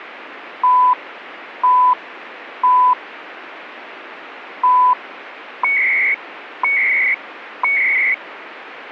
Radio time signal (CHU, Canada), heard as beeps and data bursts, one a second, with radio static.